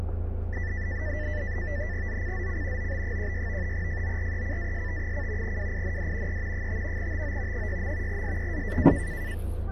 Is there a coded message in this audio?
Yes: NAVTEX (SITOR-B), 100 baud, 170 Hz shift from 0.5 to 9.3 s, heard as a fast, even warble, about 1850 Hz centre, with the noise inside a car. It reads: ZCZC OB16 FORECAST: WIND E 5 TO 6. SEA